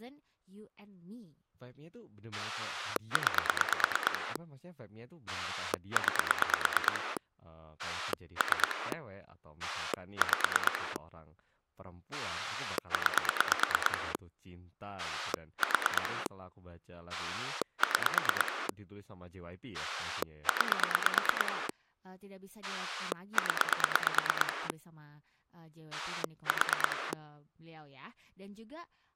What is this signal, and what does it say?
Pulse dialling, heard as a rotary dial, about 9 pulses a second, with speech in Indonesian. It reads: 9 9 3 5 9 4 6 9 0 4